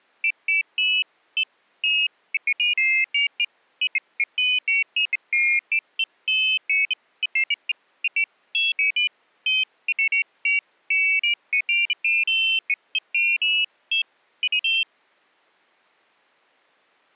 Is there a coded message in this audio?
No, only pairs of high tones at irregular times.